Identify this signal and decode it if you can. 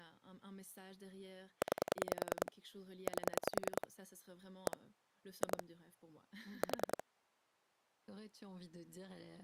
Pulse dialling, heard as clicks on a phone line, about 10 pulses a second, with speech in French. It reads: 9 8 1 2 4